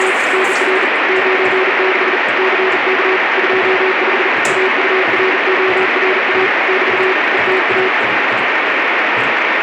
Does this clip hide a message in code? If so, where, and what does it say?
Yes: Morse code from 0.0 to 7.9 s, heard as a keyed tone, hand-sent with a bug key, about 40 wpm, 380 Hz, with heavy radio static and kitchen noise. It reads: … NR 96 CK 25 AURORA <BT> ETA